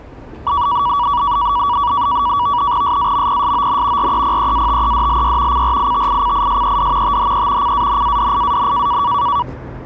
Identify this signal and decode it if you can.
NAVTEX (SITOR-B), 100 baud, 170 Hz shift, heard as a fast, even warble, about 1050 Hz centre, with street noise. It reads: SAMPSON REPEATEDLY CRITICISED THE CANADIAN